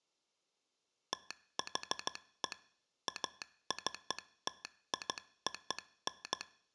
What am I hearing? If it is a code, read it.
Morse code (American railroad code), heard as a telegraph sounder, machine-sent. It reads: THE ACTION